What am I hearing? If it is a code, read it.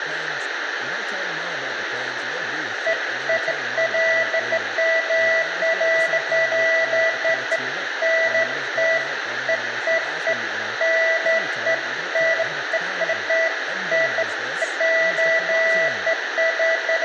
Beeps of irregular length, with radio hiss, room echo and speech in English. There is no code.